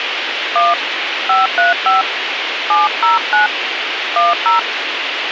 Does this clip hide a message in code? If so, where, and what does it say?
Yes: DTMF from 0.6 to 4.6 s, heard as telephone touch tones, dialled by hand, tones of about 160 ms, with radio hiss and a squelch burst at the end. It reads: 1 535 709 10